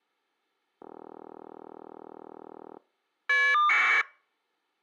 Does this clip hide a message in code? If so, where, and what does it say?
Yes: caller ID data burst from 0.8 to 4.0 s, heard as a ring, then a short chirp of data, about 1200 baud.